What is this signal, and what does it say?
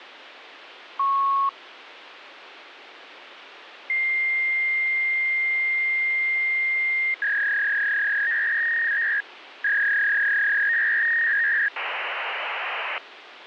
Fax machine handshake, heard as a beep, a long tone, a warble and hiss, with phone line noise.